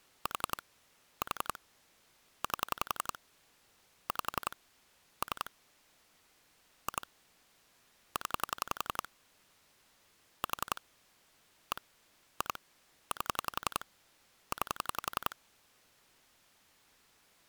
Pulse dialling, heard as clicks on a phone line, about 11 pulses a second. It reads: 4 4 8 5 3 2 0 4 1 2 8 9